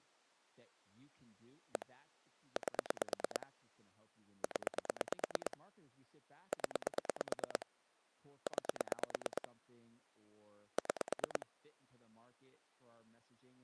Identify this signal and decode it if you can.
Pulse dialling, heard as clicks on a phone line, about 9 pulses a second, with speech in English. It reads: 1 8 0 0 9 6